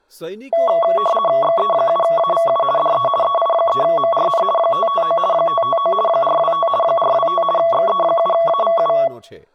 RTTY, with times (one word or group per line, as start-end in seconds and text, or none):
1.4-2.6 XE7AVU
2.8-3.1 DE
3.2-4.4 EI3MRN
4.6-5.2 559
5.3-5.9 559
6.1-6.7 425
6.8-7.4 425
7.6-8.9 XE7AVU